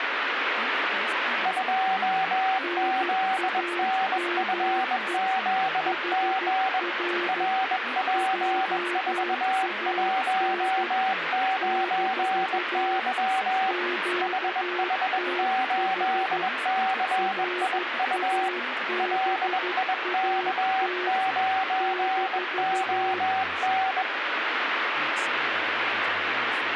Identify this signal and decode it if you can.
Morse code, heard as two keyed tones, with radio static and speech in English. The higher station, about 21 wpm, 760 Hz: 2ZNFZG RP419Y HH8CIU LIK9ON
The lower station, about 13 wpm, 360 Hz: NAME HR JAN - QTH RABAT -